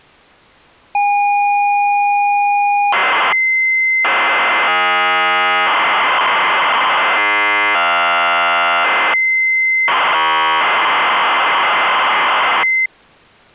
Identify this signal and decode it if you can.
ZX Spectrum tape loading, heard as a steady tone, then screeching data.